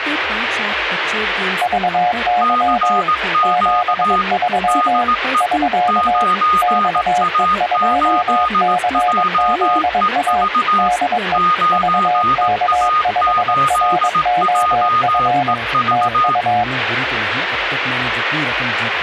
Morse code, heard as two keyed tones, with radio static. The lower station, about 22 wpm, 720 Hz: VY 73 <SK> XE2CZA DE VK5ROF TU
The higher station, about 18 wpm, 1230 Hz: CQ DE 9A8JEV 9A8JEV